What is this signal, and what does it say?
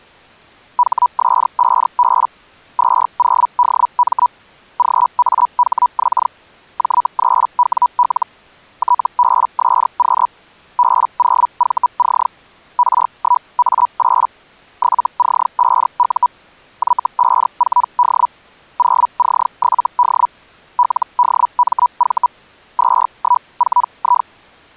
Hellschreiber (Feld-Hell, 122.5 baud), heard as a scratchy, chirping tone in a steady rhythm, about 980 Hz. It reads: HS5B 20DM GAHX J3WL TBSQ B0VC R1A8 7C5U Y54D 0C7D LDMV 214I